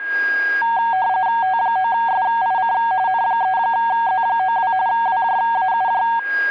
RTTY (45.45 baud, 170 Hz shift), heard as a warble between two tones, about 840 Hz centre, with a steady whistle near 1630 Hz. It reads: T9SIC N3Z92 WJAUJ